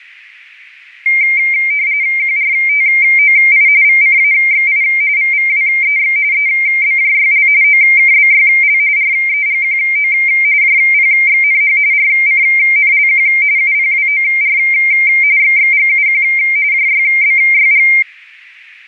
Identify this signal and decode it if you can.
RTTY (45.45 baud, 170 Hz shift), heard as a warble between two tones, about 2200 Hz centre. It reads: QRTOI VCAXI VVWEX EBJYL OKBYL REGQO JPXNH RCNLQ UPWOR XXGUQ JYBYG